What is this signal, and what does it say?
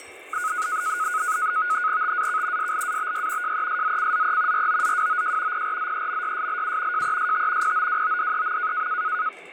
NAVTEX (SITOR-B), 100 baud, 170 Hz shift, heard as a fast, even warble, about 1360 Hz centre, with kitchen noise. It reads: TAK SLABY JESZCZE ROZWOJ PRZEMYSLU JEST POWODEM